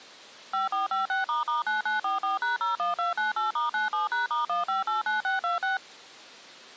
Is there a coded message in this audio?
Yes: DTMF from 0.5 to 5.8 s, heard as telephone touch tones, dialled by machine, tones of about 140 ms. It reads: 5456**9944#01298*97#*1589626